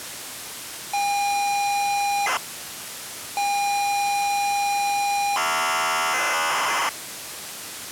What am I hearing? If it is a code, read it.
ZX Spectrum tape loading, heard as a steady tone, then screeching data, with tape hiss.